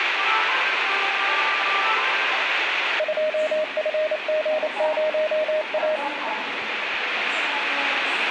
Morse code, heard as a keyed tone, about 28 wpm, 620 Hz, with radio static and the noise of a subway station. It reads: 2FG0A